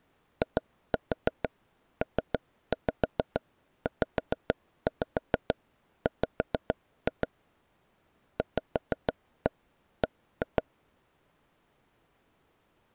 Tap code, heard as taps on a table, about 6 knocks a second. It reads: IPZW VB